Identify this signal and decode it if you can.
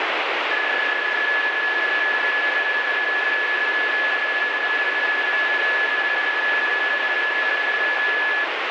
PSK31 (31.25 baud), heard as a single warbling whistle, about 1700 Hz, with radio static.